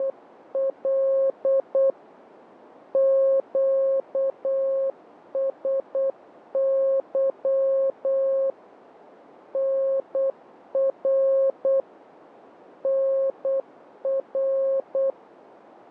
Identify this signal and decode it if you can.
Morse code, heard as a keyed tone, machine-sent, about 8 wpm, 540 Hz. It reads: … QSY NR NR